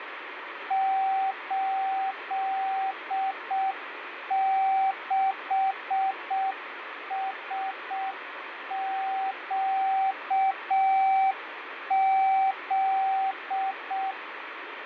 Morse code, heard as a keyed tone, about 6 wpm, 770 Hz, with radio static and fading. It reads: 86SQZ